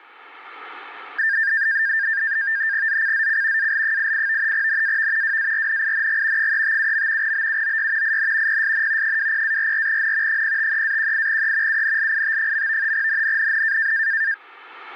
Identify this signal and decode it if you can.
NAVTEX (SITOR-B), 100 baud, 170 Hz shift, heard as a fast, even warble, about 1700 Hz centre, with static crashes. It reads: ZCZC AL88 NAV WARNING 357. BUOY IN PSN 20-44N 053-18E UNLIT. NNNN